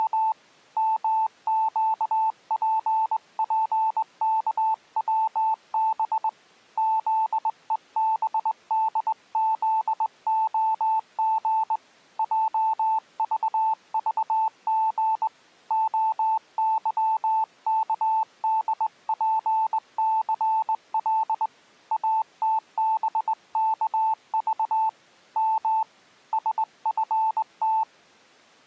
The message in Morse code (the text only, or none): … MQPPKWB ZEBDZOG JVVG OYKDPCL ATBKV M SFT